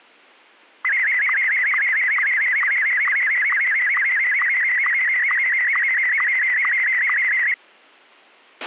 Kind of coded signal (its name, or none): SSTV (slow-scan television)